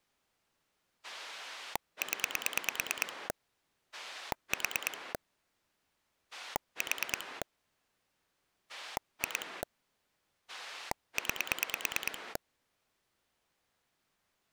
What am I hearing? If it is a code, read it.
Pulse dialling, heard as a rotary dial, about 9 pulses a second. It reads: 0 4 4 2 9